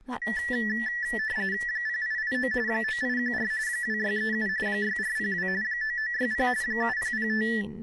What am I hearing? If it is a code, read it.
RTTY (45.45 baud, 170 Hz shift), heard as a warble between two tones, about 1850 Hz centre, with speech in English. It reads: 0889 9814 2637 6402 9960 7005